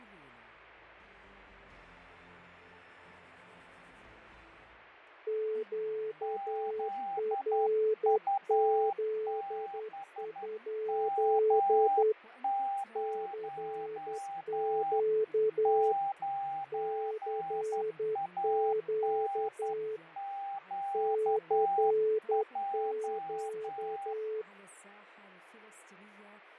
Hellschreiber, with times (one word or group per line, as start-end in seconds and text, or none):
none